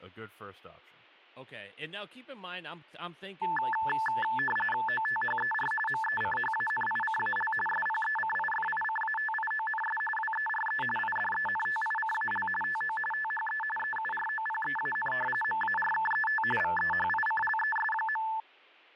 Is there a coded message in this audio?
Yes: RTTY (45.45 baud, 850 Hz shift) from 3.4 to 18.4 s, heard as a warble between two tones, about 1310 Hz centre, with speech in English. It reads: OTHER MECHANICAL SPECIFICATIONS WERE IDENTICAL TO THE EUROPEAN MARKET VEHICLES.